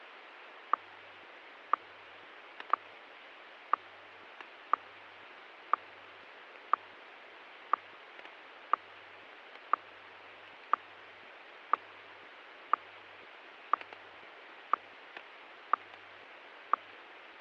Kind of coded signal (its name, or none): radio time signal